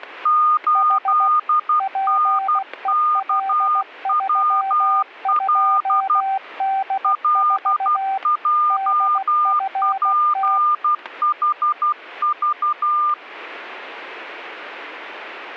Morse code, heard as two keyed tones, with static crashes. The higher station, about 12 wpm, 1210 Hz: 8NKWL LJPHV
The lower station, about 16 wpm, 780 Hz: H PEL32D4 DFT